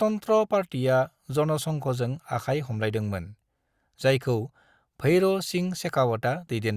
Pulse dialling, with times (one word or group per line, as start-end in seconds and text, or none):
none